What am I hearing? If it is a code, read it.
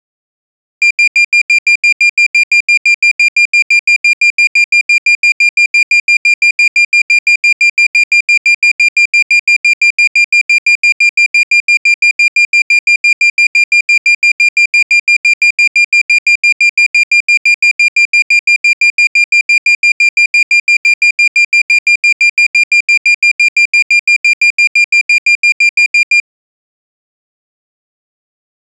Evenly repeated beeps. There is no code.